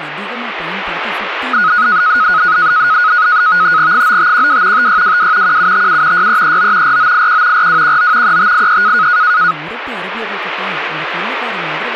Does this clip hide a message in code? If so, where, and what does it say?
Yes: NAVTEX (SITOR-B), 100 baud, 170 Hz shift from 1.5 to 9.5 s, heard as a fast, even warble, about 1360 Hz centre, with radio static and speech in Tamil. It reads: 9512 5622 1757 6339 4981 4219 3583